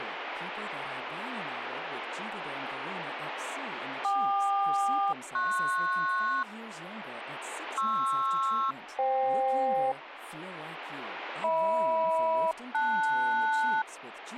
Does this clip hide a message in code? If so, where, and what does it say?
Yes: aircraft SELCAL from 4.0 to 13.8 s, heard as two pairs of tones, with radio static and speech in Dutch. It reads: KQ-PS PR-FK HM-LS